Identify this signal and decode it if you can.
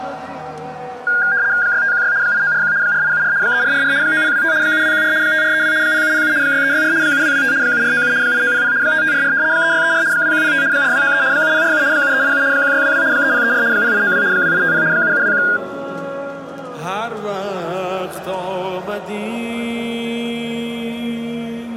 RTTY (75 baud, 170 Hz shift), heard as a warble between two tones, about 1500 Hz centre. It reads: 6516 8941 4874 3444 9025 7214 5432 0707 6364 7225 7497 8900 5544 3634 2105 4293 7047 7387 1622 3034 0892 2850 7721